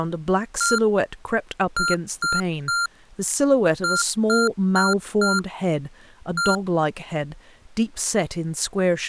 Beep code, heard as beeps from a small speaker, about 1390 Hz, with speech in English. 1-3-4-1. In Phoenix BIOS tables: memory failure on an address line.